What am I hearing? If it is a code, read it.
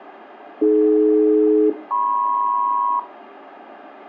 Aircraft SELCAL, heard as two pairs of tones, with radio hiss and room echo. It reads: AD-MP